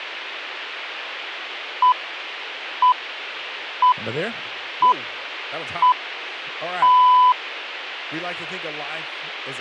Radio time signal (six pips, as the Greenwich Time Signal), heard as pips, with speech in English.